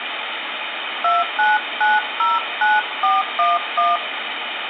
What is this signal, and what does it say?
DTMF, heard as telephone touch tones, dialled by hand, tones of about 180 ms, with phone line noise and room echo. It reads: 29909411